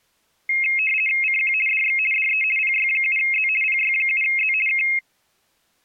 RTTY (50 baud, 450 Hz shift), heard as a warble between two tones, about 2350 Hz centre. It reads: CQ DX DE PY7Z PY7Z K